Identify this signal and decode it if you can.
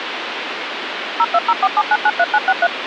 DTMF, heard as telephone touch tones, dialled by machine, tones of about 50 ms, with phone line noise. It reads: 02047993963